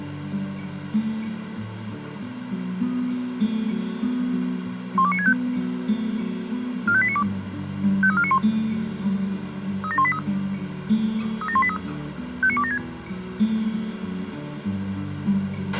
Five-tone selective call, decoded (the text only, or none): 12965 45892 53491 37183 37183 59276